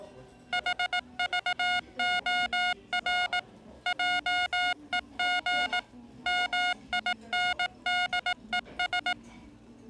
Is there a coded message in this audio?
Yes: Morse code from 0.5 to 9.2 s, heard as electronic beeps, machine-sent, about 18 wpm, 720 Hz, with the noise of a restaurant. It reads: HVOR JEG MINDES